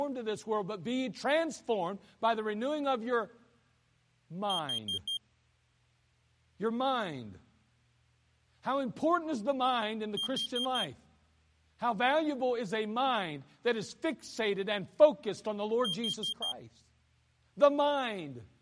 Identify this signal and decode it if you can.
Alarm pattern, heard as an alarm's beeps, played three times, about 3200 Hz, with speech in English. Temporal four. Carbon monoxide.